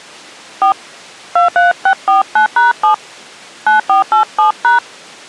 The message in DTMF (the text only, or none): 4 23649#7 9487#